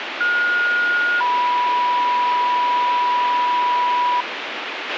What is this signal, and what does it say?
Two-tone page, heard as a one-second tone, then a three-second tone, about 1430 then 980 Hz, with radio hiss and a squelch burst at the end.